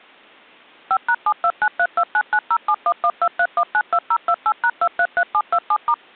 DTMF, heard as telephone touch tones, dialled by machine, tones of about 60 ms. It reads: 5#7293299071123192028#233727*